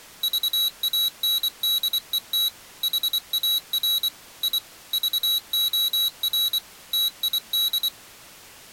Morse code, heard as a high beeper, machine-sent, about 24 wpm, 3900 Hz. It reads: VANDET HAR I VOR TID